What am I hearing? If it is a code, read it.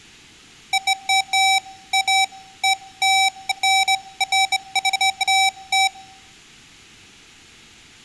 Beeps of irregular length, with room echo. There is no code.